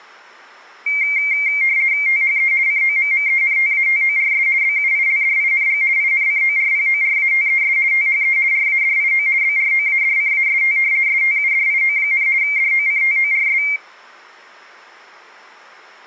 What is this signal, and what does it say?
RTTY (50 baud, 170 Hz shift), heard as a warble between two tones, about 2200 Hz centre. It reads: THE COMMENTATORS BUILDING INCORPORATES THE RADIO BROADCAST STUDIO, DOCTORS